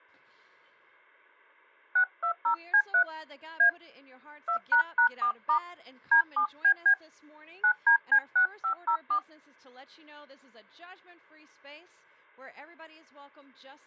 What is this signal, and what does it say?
DTMF, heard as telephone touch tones, dialled by hand, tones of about 90 ms. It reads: 620C3 A 2##4* D7BB 9DC6504